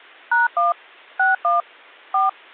DTMF, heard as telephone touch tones, dialled by machine, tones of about 160 ms. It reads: #1 61 4